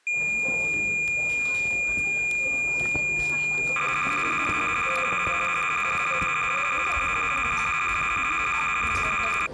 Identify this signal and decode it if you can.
Cassette data (Kansas City type), 300 baud, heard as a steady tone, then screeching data, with the noise of a crowd indoors.